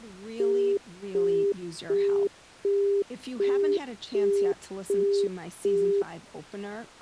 Telephone call progress tone (as in the UK, Australia and similar networks), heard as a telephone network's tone, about 400 Hz, 0.375 s on and 0.375 s off, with speech in English. Busy tone.